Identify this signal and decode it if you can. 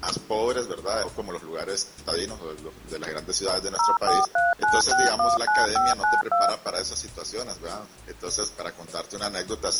DTMF, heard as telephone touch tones, dialled by machine, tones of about 180 ms. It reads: 0439619592